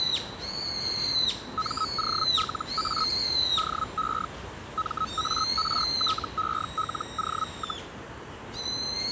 Hellschreiber (Feld-Hell, 122.5 baud), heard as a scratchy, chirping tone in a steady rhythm, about 1280 Hz, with the noise of a park. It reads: MOLA DE MARTELO,